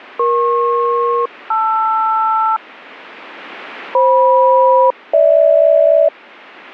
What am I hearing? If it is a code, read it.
Aircraft SELCAL, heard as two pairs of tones. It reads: EP-LR FM-GH